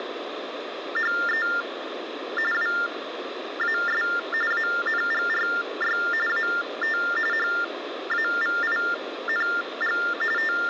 TTY/TDD text telephone tones (45.45 baud Baudot), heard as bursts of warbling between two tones, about 400 Hz shift, 1600 Hz centre, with phone line noise. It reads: … WAS ANGRY AT HAVING …